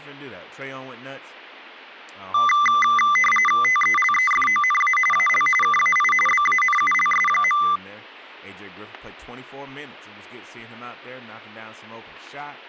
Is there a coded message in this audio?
Yes: RTTY (45.45 baud, 850 Hz shift) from 2.3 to 7.8 s, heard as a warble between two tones, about 1600 Hz centre, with speech in English. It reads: TELEFONA AL KAI BANULS.